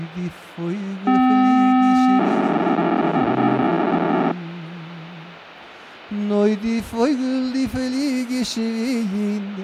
POCSAG pager data (512 baud), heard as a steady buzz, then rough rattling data, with radio hiss.